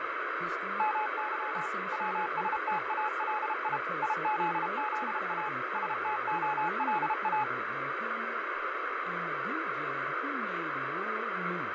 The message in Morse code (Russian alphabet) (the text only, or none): МЫ ВСТАЛИ ИЗЗА СТОЛА